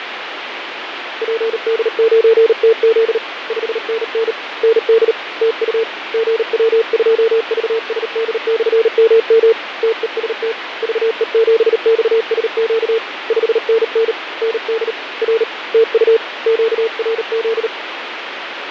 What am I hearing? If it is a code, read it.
Morse code, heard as a keyed tone, hand-sent with a paddle, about 38 wpm, 450 Hz, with radio static and fading. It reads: PD9TZ 5NN ND TU GW2VSD/MM TEST VE7XSQ 5NN ND R TU QRZ